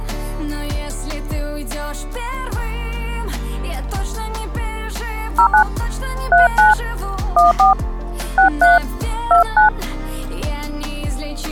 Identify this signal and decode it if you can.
DTMF, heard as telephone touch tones, dialled by hand, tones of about 120 ms. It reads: 09 39 14 63 29